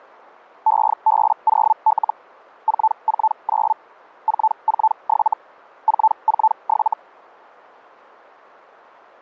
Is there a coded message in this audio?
Yes: Hellschreiber (Feld-Hell, 122.5 baud) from 0.7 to 6.9 s, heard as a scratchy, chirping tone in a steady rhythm, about 880 Hz. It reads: EB0L 449 447 447